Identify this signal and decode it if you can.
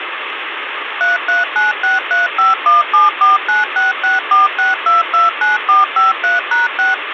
DTMF, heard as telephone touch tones, dialled by machine, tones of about 160 ms, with phone line noise. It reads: 33963517496646229453#6